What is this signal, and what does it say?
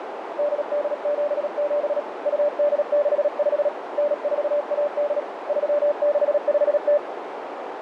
Morse code (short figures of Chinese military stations), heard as a keyed tone, hand-sent with a paddle, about 37 wpm, 590 Hz, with radio static and a narrow filter. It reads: 8877 2865 9418 3650